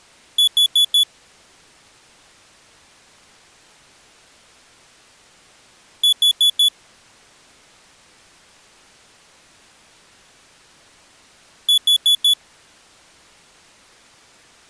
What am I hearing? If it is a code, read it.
Alarm pattern, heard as an alarm's beeps, played three times, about 3400 Hz. Temporal four. Carbon monoxide.